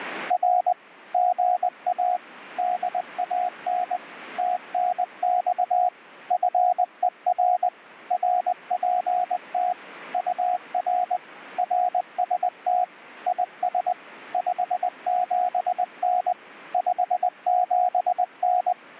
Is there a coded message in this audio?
Yes: Morse code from 0.2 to 18.8 s, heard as a keyed tone, machine-sent, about 20 wpm, 720 Hz. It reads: R GA DAN TNX FER RPT UR RST IS 57N 57N